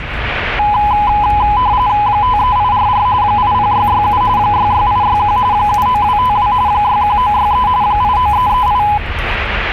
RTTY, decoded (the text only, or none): 53844 80667 66861 79252 61963 89338